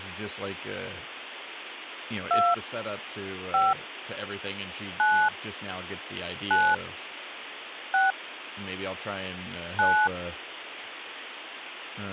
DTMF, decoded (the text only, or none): 2 5 9 9 6 9